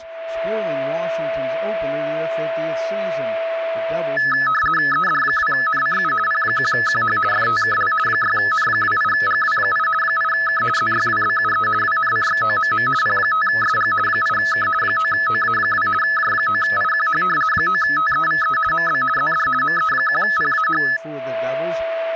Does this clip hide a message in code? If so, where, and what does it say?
Yes: RTTY (50 baud, 450 Hz shift) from 4.2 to 21.0 s, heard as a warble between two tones, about 1500 Hz centre, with a steady whistle near 660 Hz. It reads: ED2NCU P1QH FTKL 6N28GW8 8K ZYWBUE WNCXOMM P5SG 8K 9OA2 J9IQH 9TEVE MB ZD ME1PAH